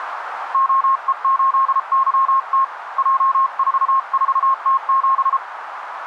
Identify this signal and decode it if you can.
Morse code, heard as a keyed tone, hand-sent with a paddle, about 33 wpm, 1070 Hz, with radio static and a narrow filter. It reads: OE8YT J44T7